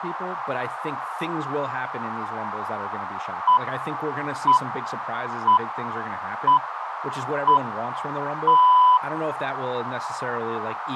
Radio time signal (six pips, as the Greenwich Time Signal), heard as pips, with radio static, a narrow filter and speech in English.